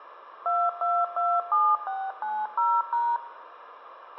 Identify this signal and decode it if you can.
DTMF, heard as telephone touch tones, dialled by machine, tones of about 240 ms, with radio hiss, a squelch burst at the end and room echo. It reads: 2227690#